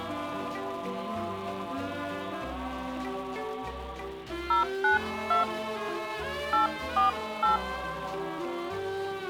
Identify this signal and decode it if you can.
DTMF, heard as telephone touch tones, dialled by hand, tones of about 140 ms. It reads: 092 848